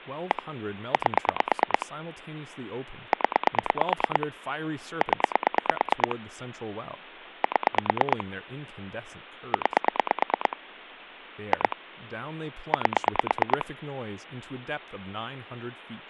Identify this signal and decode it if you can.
Pulse dialling, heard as clicks on a phone line, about 9 pulses a second, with speech in English. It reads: 1 8 0 0 7 9 2 8